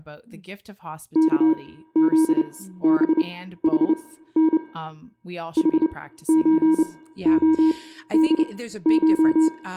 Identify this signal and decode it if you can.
Morse code (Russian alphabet), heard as a keyed tone, machine-sent, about 29 wpm, spaced as for 15 wpm, 320 Hz, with room echo and speech in English. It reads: КЗБХН ХЧОДШ